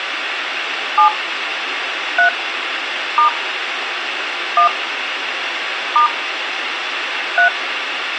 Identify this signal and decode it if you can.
DTMF, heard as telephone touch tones, dialled by hand, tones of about 110 ms, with phone line noise and room echo. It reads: 7 3 * 1 * 3